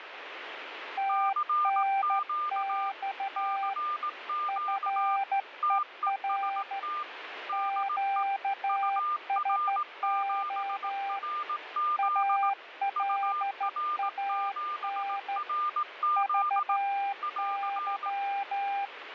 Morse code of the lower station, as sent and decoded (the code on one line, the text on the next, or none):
- -. -..- / ..-. . .-. / --.- ... --- / .- .-.. .- -. / ...- -.--
TNX FER QSO ALAN VY